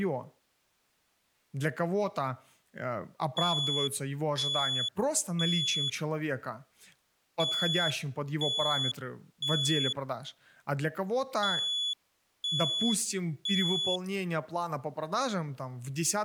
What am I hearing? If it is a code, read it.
Alarm pattern, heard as an alarm's beeps, played three times, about 3400 Hz, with speech in Russian. Temporal three. Smoke or fire, evacuate.